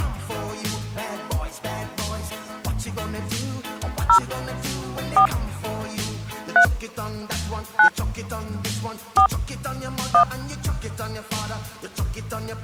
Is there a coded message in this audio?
Yes: DTMF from 4.1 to 10.2 s, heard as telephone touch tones, dialled by hand, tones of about 90 ms. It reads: 0 4 3 9 4 1